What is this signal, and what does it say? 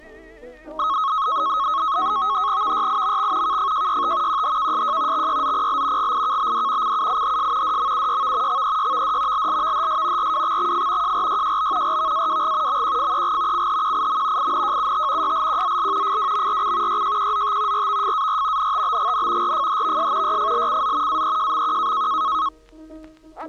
NAVTEX (SITOR-B), 100 baud, 170 Hz shift, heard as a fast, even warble, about 1180 Hz centre. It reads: VYIMX KFJYT QHKSJ XYZPL GIKBD CUIHS DMUYV XEYVD LLVHS RWXXF JRYJB RVAWG MQFEG CHQIM INJUT YLQZL FWMRC YJQZT RVFAR NTBGN RFHVS YFLCZ AEJMQ